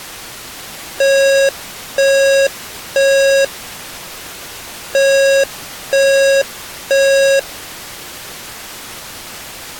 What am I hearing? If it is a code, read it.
Alarm pattern, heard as an alarm's beeps, played twice, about 550 Hz. Temporal three. Smoke or fire, evacuate.